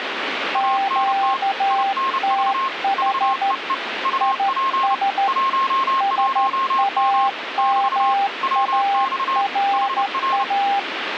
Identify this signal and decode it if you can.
Morse code, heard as two keyed tones, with radio static. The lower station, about 13 wpm, 790 Hz: QTH IS SAMARA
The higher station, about 30 wpm, 1070 Hz: ANT INV VEE UP 11M <BT> WX HR